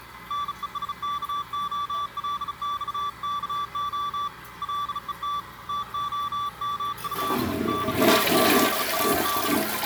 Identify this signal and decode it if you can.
Morse code (Russian alphabet), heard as a keyed tone, hand-sent with a bug key, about 35 wpm, 1160 Hz, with the noise of a restroom. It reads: НЕСКОЛЬКО ЛЕТ ТОМУ НАЗАД